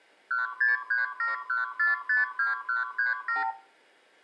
Multi-frequency trunk signalling (R2, with the far end's replies), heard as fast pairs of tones, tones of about 150 ms, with room echo. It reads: 16371452137